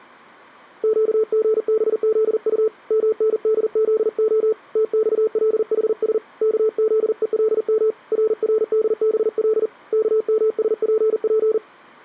Morse code, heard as a keyed tone, hand-sent with a paddle, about 40 wpm, 440 Hz. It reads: QGBZU MNDZO TXLHS KZELM RRDBL KMSPP